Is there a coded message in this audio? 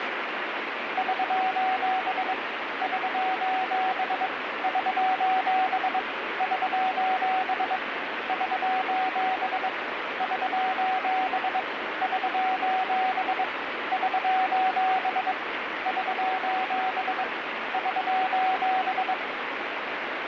Yes: Morse code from 0.9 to 19.2 s, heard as a keyed tone, hand-sent with a bug key, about 22 wpm, 750 Hz, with radio static. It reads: <SOS> <SOS> <SOS> <SOS> <SOS> <SOS> <SOS> <SOS> <SOS> <SOS>